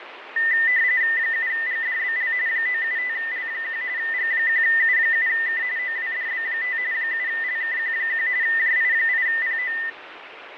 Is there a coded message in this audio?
Yes: RTTY (45.45 baud, 170 Hz shift) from 0.4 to 9.9 s, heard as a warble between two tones, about 1900 Hz centre, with radio static and fading. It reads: 7GDBL 975L1 G1U7K OWDB5 7LKQ1 JI8PO